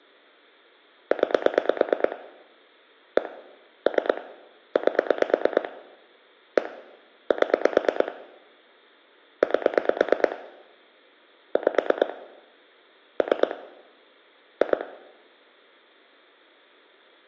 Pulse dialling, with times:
1.1-2.2 9
3.2-3.3 1
3.9-4.2 3
4.8-5.7 8
6.6-6.7 1
7.3-8.1 7
9.4-10.4 8
11.6-12.1 5
13.2-13.5 3
14.6-14.8 2

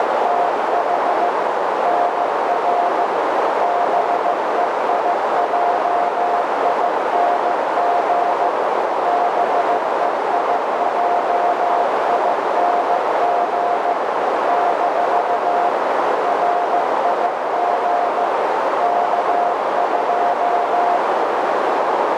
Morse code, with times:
0.0-1.3 …
1.8-3.0 NR
3.6-8.5 BEIJING
9.0-13.9 BEIJING
14.5-15.7 -
16.2-18.2 RIG
18.8-21.0 K2

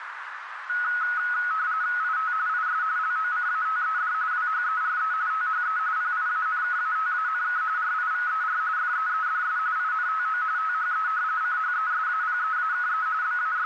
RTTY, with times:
2.0-2.3 IT
2.5-2.8 IS
3.0-4.1 LOCATED
4.3-5.1 WHERE
5.3-5.8 THE
6.0-7.6 PIANKATANK
7.8-8.6 RIVER
8.8-9.6 FEEDS
9.8-10.4 INTO
10.6-11.1 THE
11.4-13.1 CHESAPEAKE
13.2-13.7 …

